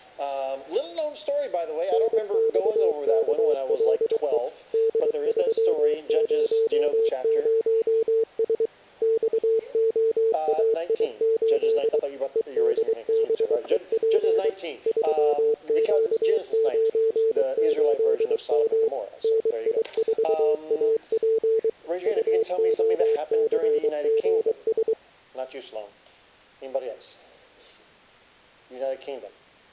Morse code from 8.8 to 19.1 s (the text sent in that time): XOAI8 EDBEP 3Q98M